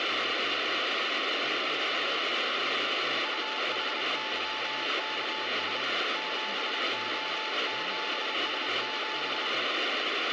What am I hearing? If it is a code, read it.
Morse code, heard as a keyed tone, hand-sent with a bug key, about 29 wpm, 870 Hz, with radio static and speech in English. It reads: UHYKS 7O7S7